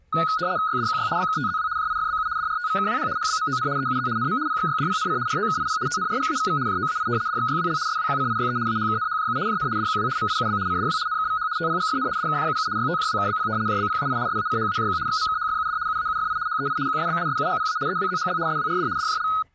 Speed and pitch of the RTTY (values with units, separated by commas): 75 baud, 170 Hz shift, 1360 Hz centre